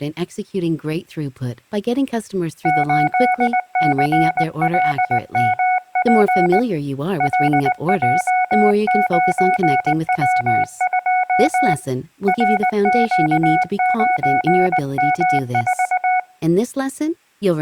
Morse code, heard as a keyed tone, hand-sent with a straight key, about 19 wpm, 740 Hz. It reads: 8CLMP LJ9W2 RQ9M4